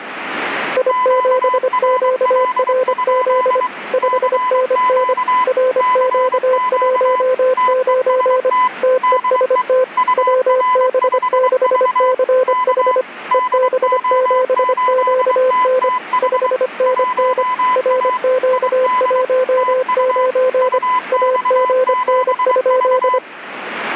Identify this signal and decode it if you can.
Morse code, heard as two keyed tones, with radio static. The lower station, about 25 wpm, 510 Hz: I7QRZ 5NN RQ19 TEST WB6CH EB7QN 5NN RQ19 AGN?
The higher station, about 23 wpm, 1010 Hz: QRL? CQ CQ TEST DE UR5V K DO8TTH 1A ID TU UX7V